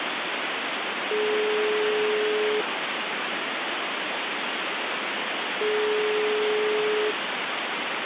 Telephone call progress tone (single-tone plan, as in most of Europe), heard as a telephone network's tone, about 420 Hz, 1.5 s on and 3 s off, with phone line noise. Ringback tone.